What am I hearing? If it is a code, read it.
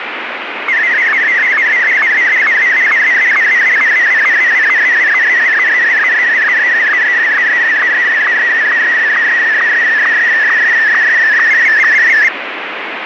SSTV (slow-scan television), Martin M1, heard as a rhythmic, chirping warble, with radio static.